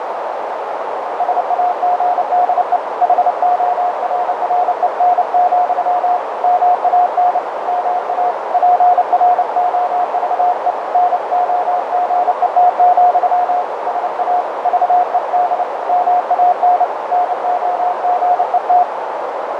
Morse code, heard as a keyed tone, hand-sent with a paddle, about 29 wpm, 720 Hz, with heavy radio static and a narrow filter. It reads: SAGDE HORREN, MAN MA PROVE NOGET, SA VED MAN NOGET